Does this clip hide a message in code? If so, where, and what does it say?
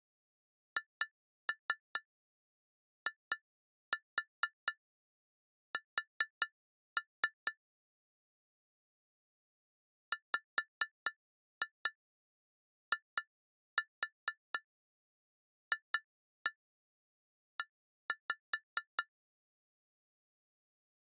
Yes: tap code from 0.8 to 19.1 s, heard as taps on glass, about 4 knocks a second. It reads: HIS WIFE